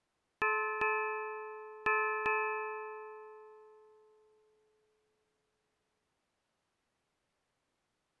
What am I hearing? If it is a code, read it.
Ship's bell, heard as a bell. 4. Four half-hours of the watch have passed.